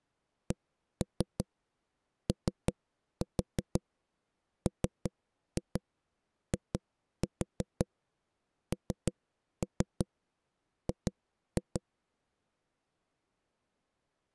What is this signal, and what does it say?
Tap code, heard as knocks on a wall, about 5 knocks a second. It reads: COMING